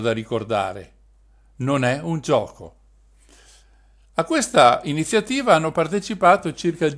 Speech in Italian. There is no code.